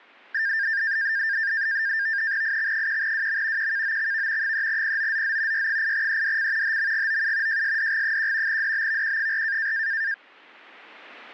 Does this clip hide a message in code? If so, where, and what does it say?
Yes: NAVTEX (SITOR-B), 100 baud, 170 Hz shift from 0.3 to 10.1 s, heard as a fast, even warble, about 1700 Hz centre. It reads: IX1WM QKOXV 3POZZ Y8EDC HMGOU JSDG1 DBVQ4